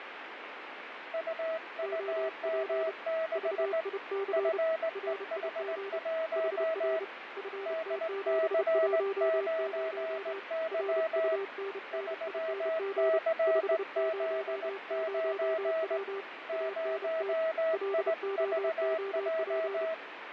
Morse code, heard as two keyed tones, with radio static and fading. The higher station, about 18 wpm, 650 Hz: UUM6 FEH1 DC9Y 3CZ9 0IVJ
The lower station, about 30 wpm, 390 Hz: OP VIC RIG HR FT710 RUNNING 500W ANT LOOP